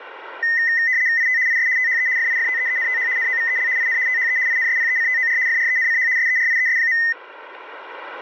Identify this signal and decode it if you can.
RTTY (75 baud, 170 Hz shift), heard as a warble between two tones, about 1950 Hz centre, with radio static. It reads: IT IS THE FIFTEENTH NOVEL IN THE INSPECTOR FRENCH SERIES.